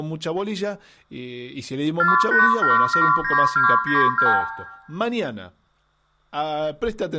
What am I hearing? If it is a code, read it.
Multi-frequency trunk signalling (R2, with the far end's replies), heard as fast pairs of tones, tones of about 160 ms, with room echo and speech in Spanish. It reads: 48779292